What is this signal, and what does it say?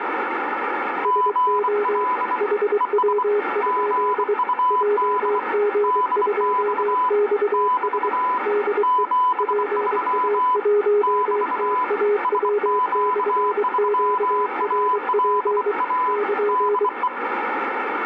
Morse code, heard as two keyed tones, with radio static. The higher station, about 24 wpm, 1000 Hz: GL ES GUD DX <BT> 73 <BT> SQ3ALA DE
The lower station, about 23 wpm, 410 Hz: SO HW? JG2XS DE PA1TAW/QRP <KN>